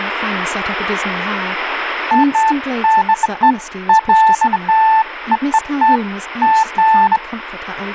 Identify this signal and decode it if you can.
Beeps of irregular length, with radio static and speech in English. There is no code.